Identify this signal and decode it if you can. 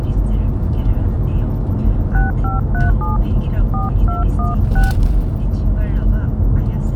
DTMF, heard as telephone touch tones, dialled by hand, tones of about 150 ms, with the noise inside a car. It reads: 6537 4216